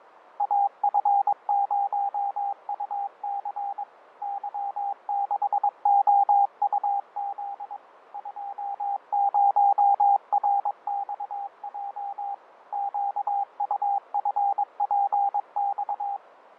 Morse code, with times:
0.4-3.8 AF0UC
4.2-7.8 Y6OUZ
8.1-12.3 20RXJ
12.7-16.2 QUFPX

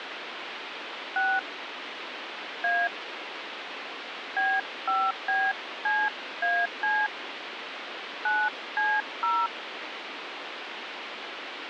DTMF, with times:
1.2-1.4 6
2.6-2.9 A
4.4-7.1 B5BCAC
8.3-9.5 9C0

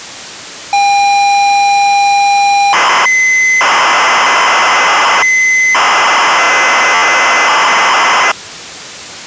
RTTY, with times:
none

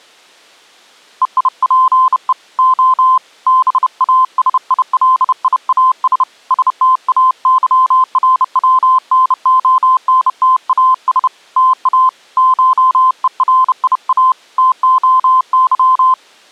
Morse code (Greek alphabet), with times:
1.2-2.3 ΕΙΠΕ
2.6-3.2 Ο
3.5-6.2 ΒΑΣΙΛΙΑΣ
6.5-11.3 ΣΤΑΥΡΩΝΟΝΤΑΣ
11.6-12.1 ΤΑ
12.4-14.3 ΧΕΡΙΑ
14.6-16.1 ΤΟΥ

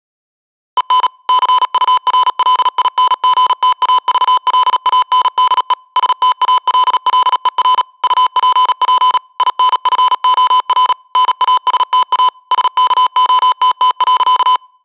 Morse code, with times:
0.8-1.1 EN
1.3-5.7 CURLINGTAVLANDE
6.0-7.8 STALLER
8.0-9.2 UPP
9.4-10.9 INFOR
11.2-12.3 NASTA
12.5-14.6 SKOTT.

